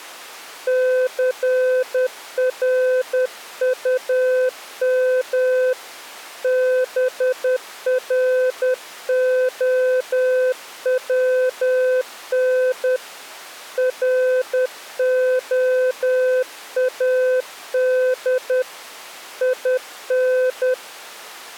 Morse code, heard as a keyed tone, hand-sent with a paddle, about 10 wpm, 510 Hz. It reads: CRUM BROWN ROAD IN